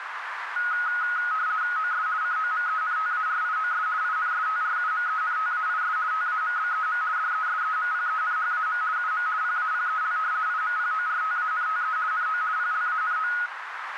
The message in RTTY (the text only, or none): OS COMENTARIOS INSTRUMENTAIS TAMBEM DESEMPENHAM UM PAPEL IMPORTANTE NO PLANO